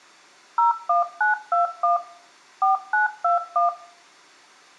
DTMF, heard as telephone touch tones, dialled by machine, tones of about 140 ms, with room echo. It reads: 01921 4921